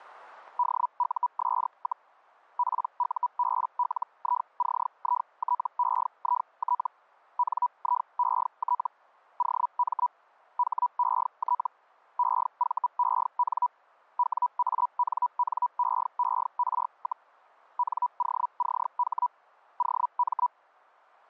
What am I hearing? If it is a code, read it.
Hellschreiber (Feld-Hell, 122.5 baud), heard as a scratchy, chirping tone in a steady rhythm, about 980 Hz, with static crashes. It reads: DUS, PUBLICITEIT NIET OM HET EVEN WANNEER, NOCH OM